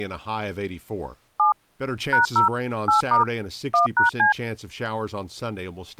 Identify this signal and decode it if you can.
DTMF, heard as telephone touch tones, dialled by machine, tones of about 130 ms, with speech in English. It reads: 7 #0 8* 1#C